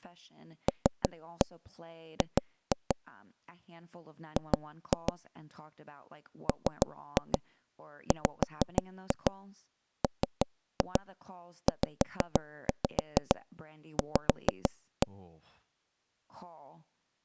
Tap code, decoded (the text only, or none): LG G MWMZV